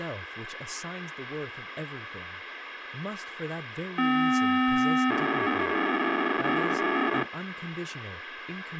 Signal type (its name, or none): POCSAG pager data